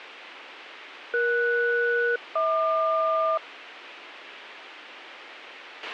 Aircraft SELCAL, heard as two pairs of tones, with radio hiss and a squelch burst at the end. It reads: ES-HQ